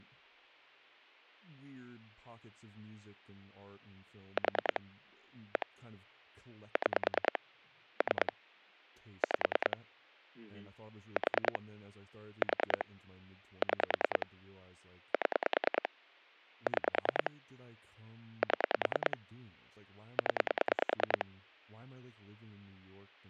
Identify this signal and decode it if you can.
Pulse dialling, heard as clicks on a phone line, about 10 pulses a second, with speech in English. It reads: 4 1 6 3 5 4 4 6 7 6 7 0